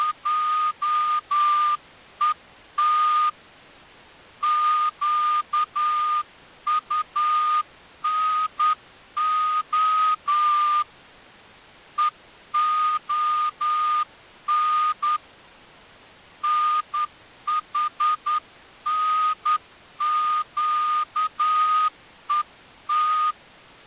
Morse code (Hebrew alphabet), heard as a whistle, hand-sent with a straight key, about 10 wpm. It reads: … קטנה והן נחנקות